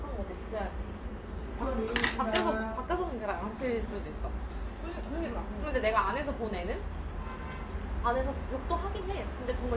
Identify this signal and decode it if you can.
The noise of a restaurant. There is no code.